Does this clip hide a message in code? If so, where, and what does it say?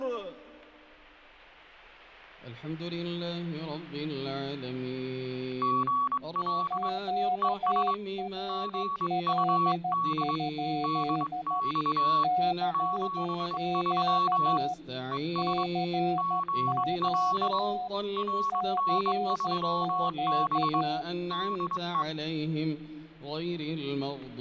Yes: Morse code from 5.6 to 22.1 s, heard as two keyed tones, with static crashes. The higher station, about 22 wpm, 1120 Hz: GL ES GUD DX 73 ES GL RN3B DE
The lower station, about 13 wpm, 730 Hz: QRL? CQ CQ CQ